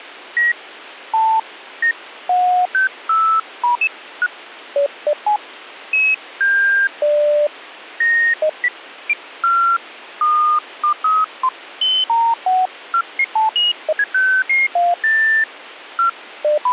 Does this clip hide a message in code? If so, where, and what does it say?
No, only electronic bleeps of random pitch and length, with phone line noise.